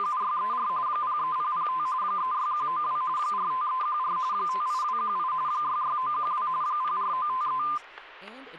RTTY (45.45 baud, 170 Hz shift), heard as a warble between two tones, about 1120 Hz centre, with static crashes and speech in English. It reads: … 03005 36192 45314 58218 66912 04953